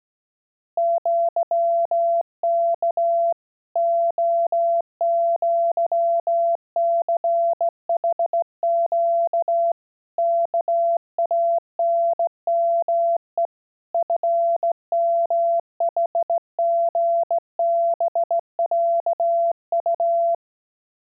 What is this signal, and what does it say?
Morse code (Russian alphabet), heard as a keyed tone, hand-sent with a straight key, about 17 wpm, 680 Hz. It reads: ЪК ОЪЦХЩ КАНМЕ ФМХГБЯУ